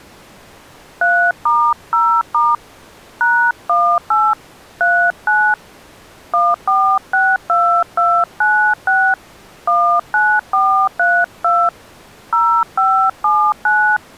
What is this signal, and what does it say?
DTMF, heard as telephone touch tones, dialled by hand, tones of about 270 ms. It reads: 3*0* #18 39 1462296 19432 0579